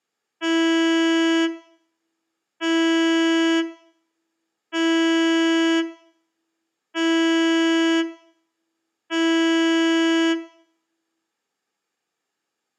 Ship horn signal, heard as a ship's horn, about 330 Hz, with room echo. 5 short. At sea: I doubt that you are doing enough to avoid a collision.